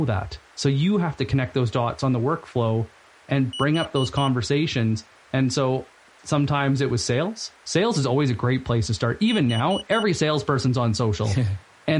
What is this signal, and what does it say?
Alarm pattern, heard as an alarm's beeps, played twice, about 2950 Hz, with speech in English. Temporal four. Carbon monoxide.